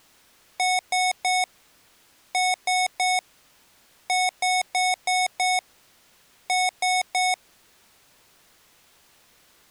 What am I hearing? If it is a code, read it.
Beep code, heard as beeps from a small speaker, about 740 Hz. 3-3-5-3.